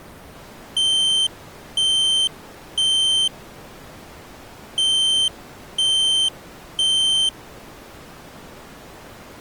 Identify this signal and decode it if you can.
Alarm pattern, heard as an alarm's beeps, played twice, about 3100 Hz. Temporal three. Smoke or fire, evacuate.